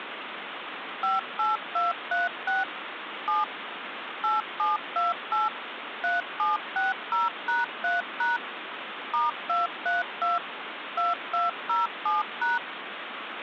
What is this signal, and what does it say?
DTMF, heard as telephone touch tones, dialled by machine, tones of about 160 ms, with phone line noise. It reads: 58236 7 8728 3760#3# *232 2207#